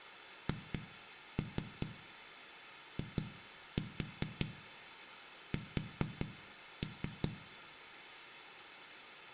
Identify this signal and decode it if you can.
Tap code, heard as knocks on a wall, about 5 knocks a second, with room echo. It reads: HIS